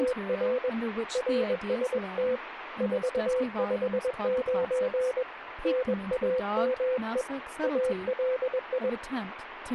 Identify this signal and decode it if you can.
Morse code, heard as a keyed tone, hand-sent with a paddle, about 21 wpm, 510 Hz, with radio static and speech in English. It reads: … RST 459 NAME ALI